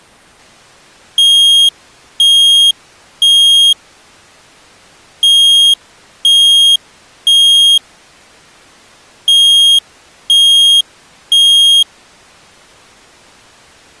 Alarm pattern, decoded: temporal three

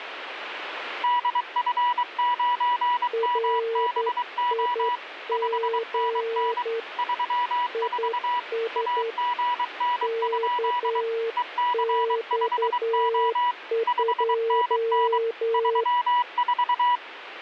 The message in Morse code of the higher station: DF9MBO 5NN 34 AGN? EC5O 5NN 34

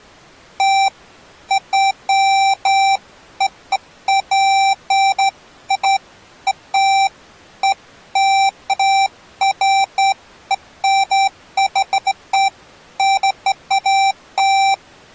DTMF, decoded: none

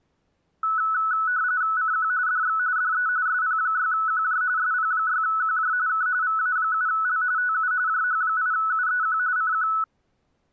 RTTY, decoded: CQ DX DE SP6QJ SP6QJ K VA7L TU JH8UEQ CQ

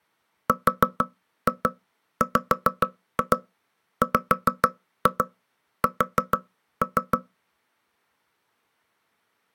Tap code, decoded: RWWS

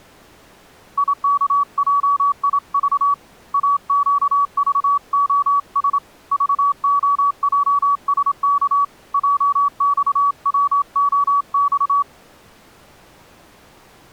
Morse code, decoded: IKJIV AQVOS VOJSK JXWOX

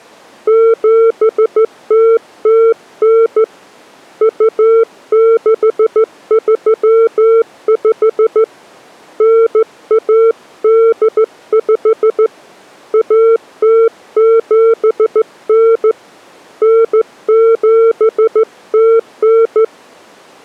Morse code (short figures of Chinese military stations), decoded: 7009 2635 9185 1079 9709

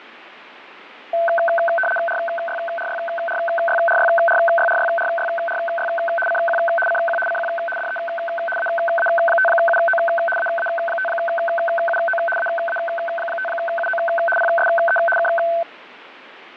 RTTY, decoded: RYRYRYRYRYRYRYRY CQ CQ CQ DE AA5UO AA5UO AA5UO PSE K

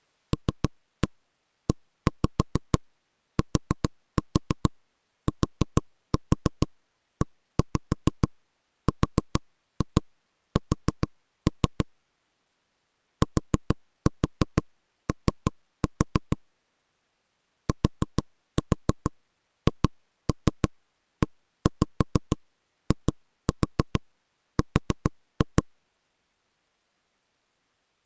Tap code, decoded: LETTERS TO THEIR

